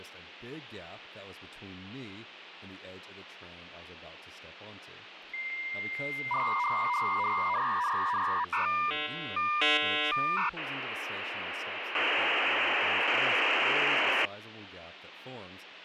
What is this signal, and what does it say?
Dial-up modem handshake (V.34 or later), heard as a whistle, warbles, then hiss, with phone line noise and speech in English.